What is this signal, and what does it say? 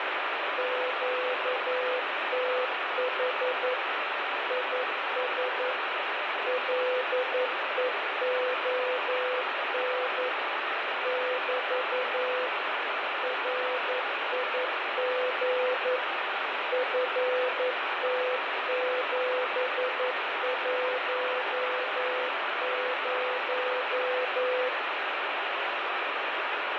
Morse code, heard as a keyed tone, machine-sent, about 11 wpm, 500 Hz, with heavy radio static. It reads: QTH IS LEON <BT> RIG FT710